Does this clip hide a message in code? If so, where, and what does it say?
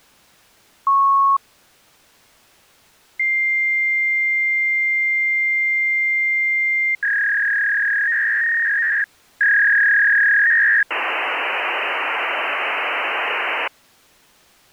Yes: fax machine handshake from 0.9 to 13.7 s, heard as a beep, a long tone, a warble and hiss.